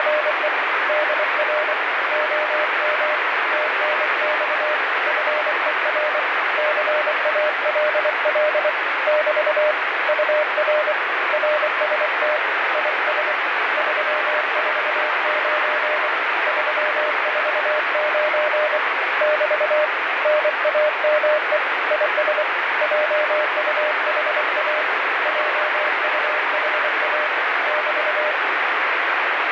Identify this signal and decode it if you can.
Morse code, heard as a keyed tone, hand-sent with a paddle, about 24 wpm, 610 Hz, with heavy radio static. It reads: … DR OM TNX FER CALL <BT> UR RST IS 349 349 <BT> NAME IS JUHA JUHA <BT>